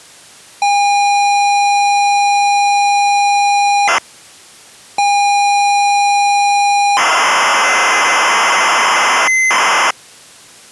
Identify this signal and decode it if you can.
ZX Spectrum tape loading, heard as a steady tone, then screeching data.